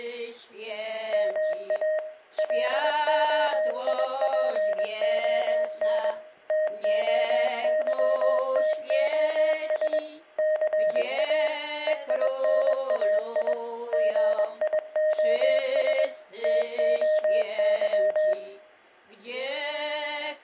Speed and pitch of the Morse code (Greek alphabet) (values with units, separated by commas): 21 wpm, 620 Hz